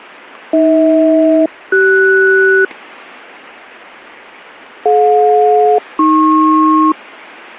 Aircraft SELCAL, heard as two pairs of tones. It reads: AH-CS DJ-AP